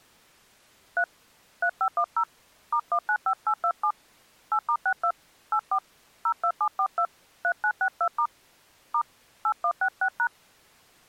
DTMF, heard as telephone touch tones, dialled by hand, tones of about 70 ms. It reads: 3 3510 *195827 8*62 84 02742 3962* * 8166#